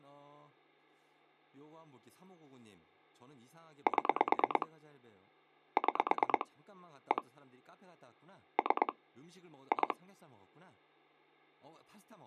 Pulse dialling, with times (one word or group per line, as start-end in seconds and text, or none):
3.9-4.7 7
5.8-6.5 6
7.1-7.2 1
8.6-8.9 3
9.7-9.9 2